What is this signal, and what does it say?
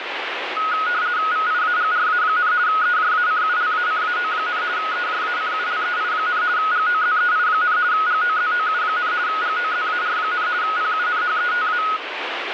RTTY (50 baud, 170 Hz shift), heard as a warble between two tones, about 1360 Hz centre, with radio static. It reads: VIAGRA, EJACULACAO, EJACULEI, GOZEI, GOZOU, GOZAR, PUNHETA